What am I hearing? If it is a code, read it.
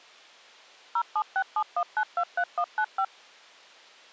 DTMF, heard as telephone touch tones, dialled by machine, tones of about 70 ms. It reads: 07671923195